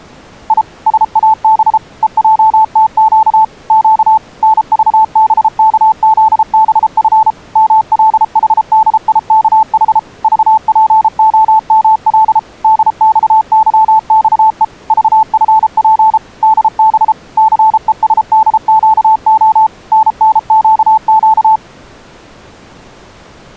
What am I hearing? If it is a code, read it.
Morse code, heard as a keyed tone, machine-sent, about 33 wpm, 880 Hz. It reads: I SAB EJTQ Q NVBKZBF MLHDIKH VPOML DXYXE VFP DB CESDQO NNQQ